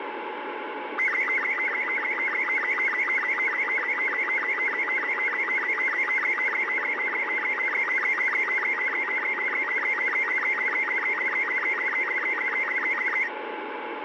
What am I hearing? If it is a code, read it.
SSTV (slow-scan television), Robot 36, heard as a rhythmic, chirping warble, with radio static.